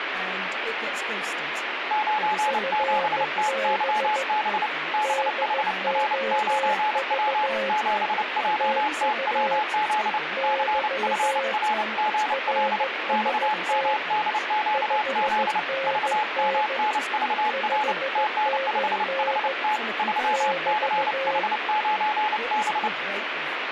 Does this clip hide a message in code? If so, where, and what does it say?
Yes: Morse code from 1.8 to 22.9 s, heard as two keyed tones, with radio static. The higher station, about 29 wpm, 850 Hz: 97TYB BHR9W 7JTWZ CFRGL XMDQZ VMNVR TN5HT 3CH9B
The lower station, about 15 wpm, 540 Hz: FB DOV TU <BT> RST 5NN 5NN <BT>